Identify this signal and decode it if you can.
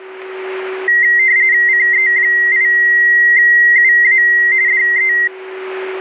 RTTY (45.45 baud, 170 Hz shift), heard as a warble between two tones, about 2000 Hz centre, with a steady whistle near 380 Hz. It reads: CE8UA DE